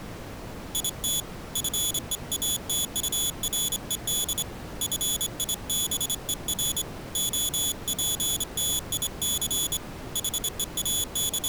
Morse code, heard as a high beeper, hand-sent with a straight key, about 25 wpm, 3400 Hz. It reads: IT FEATURED FIBER OPTIC …